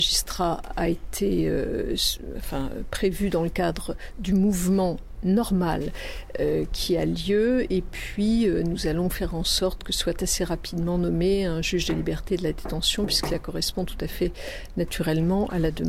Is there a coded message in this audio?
No.